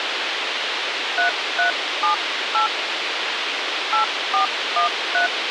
DTMF, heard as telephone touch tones, dialled by hand, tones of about 120 ms, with radio hiss. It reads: 3378 8413